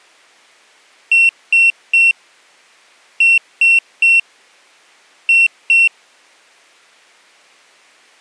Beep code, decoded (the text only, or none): 3-3-2